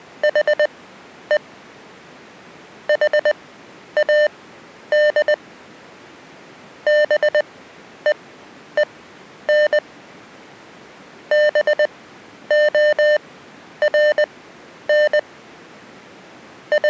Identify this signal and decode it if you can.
Morse code, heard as electronic beeps, machine-sent, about 20 wpm, spaced as for 10 wpm, 600 Hz. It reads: HE HAD BEEN BORN …